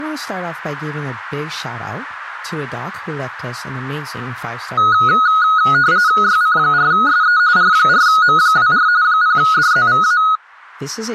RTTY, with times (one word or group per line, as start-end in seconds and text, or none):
6.2-7.4 YC4SE
7.6-8.9 R4M24
9.0-10.2 0DZVA